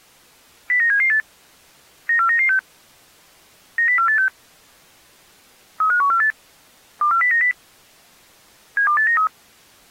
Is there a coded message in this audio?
Yes: five-tone selective call (CCIR) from 0.7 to 9.3 s, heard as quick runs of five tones, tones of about 100 ms. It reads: 09778 94996 90486 35148 24090 72893